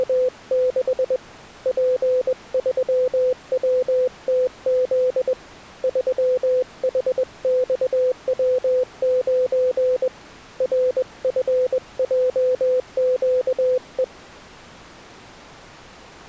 Morse code, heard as a keyed tone, hand-sent with a paddle, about 21 wpm, 510 Hz. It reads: … P3WTZ 3HXW9 RFJQE